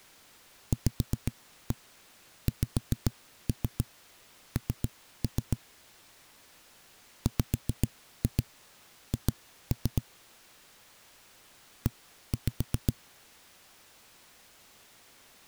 Tap code, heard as knocks on a wall, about 7 knocks a second. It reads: VXN WH E